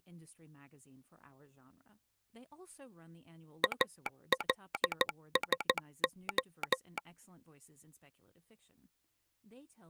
Morse code, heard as a telegraph sounder, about 14 wpm, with speech in English. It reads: ALSO